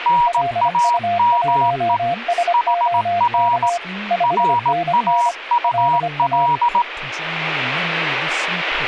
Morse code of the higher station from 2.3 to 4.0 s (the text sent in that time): HR